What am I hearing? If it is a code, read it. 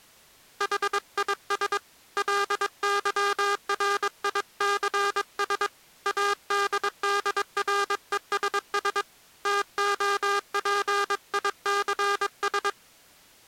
Morse code, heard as a buzzer, hand-sent with a paddle, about 22 wpm. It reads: HIS LYRICS ADDRESS TOPICS